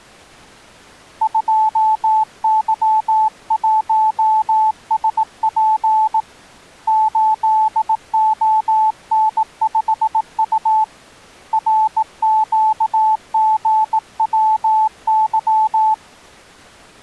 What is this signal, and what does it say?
Morse code, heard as a keyed tone, hand-sent with a bug key, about 18 wpm, 870 Hz. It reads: 2Y1SP 8ON5U RQGWY